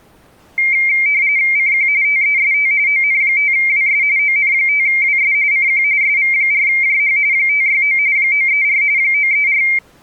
RTTY (45.45 baud, 170 Hz shift), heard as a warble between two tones, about 2200 Hz centre. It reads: CQ TEST ON5WS ON5WS CQ SV4JH 569 934 934